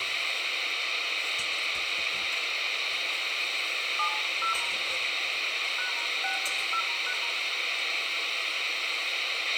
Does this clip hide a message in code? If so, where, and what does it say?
Yes: DTMF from 4.0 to 7.1 s, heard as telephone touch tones, dialled by hand, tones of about 100 ms, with radio hiss, a squelch burst at the end, room echo and kitchen noise. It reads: 70 #60#